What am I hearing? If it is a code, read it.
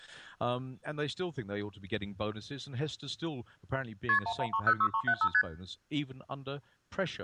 Multi-frequency trunk signalling (R1, as on North American trunks), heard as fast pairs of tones, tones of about 70 ms. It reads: KP 11306375 ST